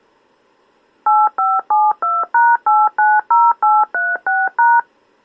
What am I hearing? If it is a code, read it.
DTMF, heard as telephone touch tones, dialled by machine, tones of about 210 ms. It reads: 8572#890836#